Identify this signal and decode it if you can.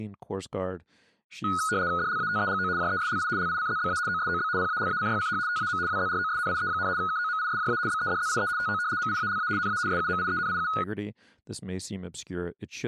RTTY (75 baud, 170 Hz shift), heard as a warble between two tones, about 1360 Hz centre, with speech in English. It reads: DLATEGO JESLI LICZBA OSOB PALACYCH TAM WZROSNIE, KOMISJA BEDZIE TO MIALA NA SUMIENIU